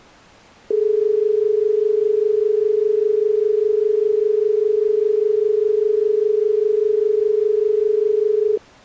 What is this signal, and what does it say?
Telephone call progress tone (as in Australia), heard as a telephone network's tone, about 430 Hz. Dial tone.